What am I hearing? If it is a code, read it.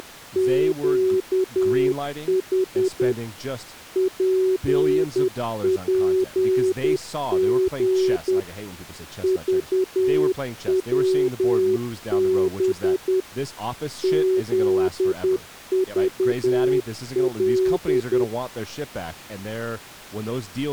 Morse code, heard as a keyed tone, machine-sent, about 10 wpm, 380 Hz, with speech in English. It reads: … PPG VWB ZVL